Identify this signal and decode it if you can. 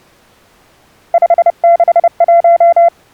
Morse code, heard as a keyed tone, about 30 wpm, 680 Hz. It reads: 561